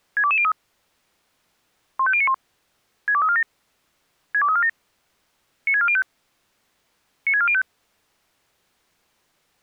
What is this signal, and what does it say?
Five-tone selective call (ZVEI), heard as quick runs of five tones, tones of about 70 ms. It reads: 62203 15091 62347 62347 96405 96405